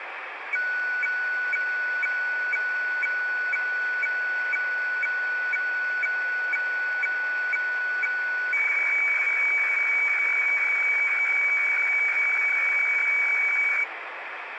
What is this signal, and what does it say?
Weather fax (radiofax), 120 lines a minute, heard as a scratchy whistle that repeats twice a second, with radio static.